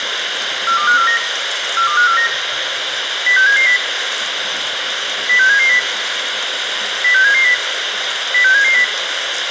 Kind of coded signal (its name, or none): five-tone selective call